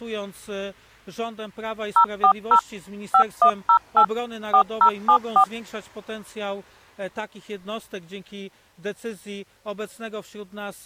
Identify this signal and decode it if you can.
DTMF, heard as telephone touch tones, dialled by machine, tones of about 80 ms. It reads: 040 5108 4074